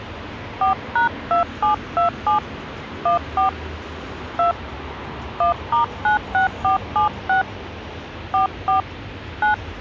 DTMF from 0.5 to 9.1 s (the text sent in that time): 4#2727 14 2 1*96476 44